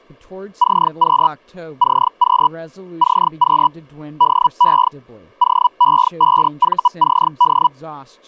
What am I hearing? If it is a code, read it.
Hellschreiber (Feld-Hell, 122.5 baud), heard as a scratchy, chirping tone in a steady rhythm, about 980 Hz, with speech in English. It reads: CQ CQ CQ DE OE5VCD